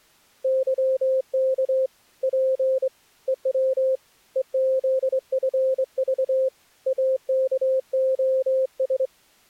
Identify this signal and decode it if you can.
Morse code, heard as a keyed tone, hand-sent with a straight key, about 24 wpm, 520 Hz. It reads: YK P EW EZFV AKOS